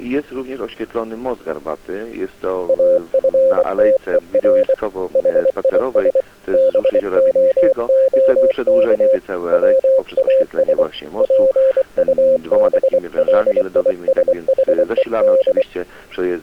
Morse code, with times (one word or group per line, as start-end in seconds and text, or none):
2.7-4.7 AFTER
5.2-6.2 HIS
6.5-9.2 BOOK
9.5-10.8 WAS
11.2-15.6 PUBLISHED